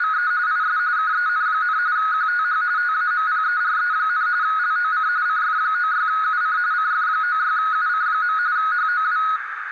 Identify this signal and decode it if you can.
RTTY (45.45 baud, 170 Hz shift), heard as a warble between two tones, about 1360 Hz centre, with radio static and a narrow filter. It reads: … IS KEN, QTH TAMPERE, LOC CF96UC CF96UC. HOW